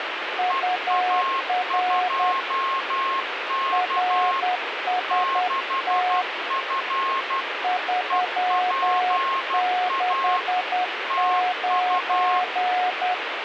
Morse code, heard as two keyed tones, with radio static. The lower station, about 10 wpm, 730 Hz: UR RST 369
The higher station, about 12 wpm, 1080 Hz: EA2K 6F EPA TU